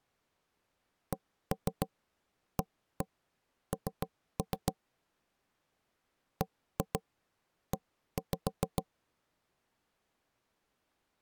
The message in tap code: CAN BE

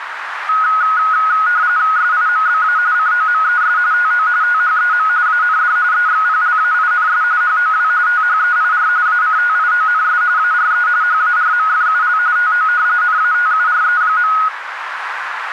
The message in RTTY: SIMBA COMES TO THEM AND EXPLAINS HOW THEIR ACTIONS ARE HARMFUL TO NATURE.

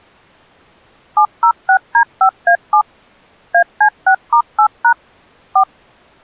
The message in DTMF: 706D5A7 AC6*8# 4

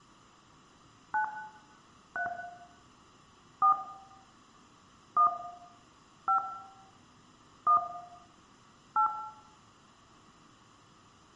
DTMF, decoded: 9 3 4 1 5 1 8

